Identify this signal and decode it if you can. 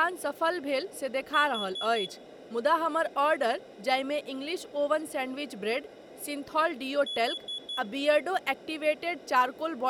Alarm pattern, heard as an alarm's beeps, played twice, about 3400 Hz, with room echo and speech in Maithili. Temporal four. Carbon monoxide.